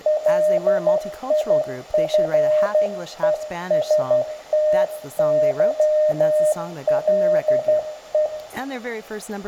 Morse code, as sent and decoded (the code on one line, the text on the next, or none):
.-.. .. ..-. . ... - -.-- .-.. .
LIFESTYLE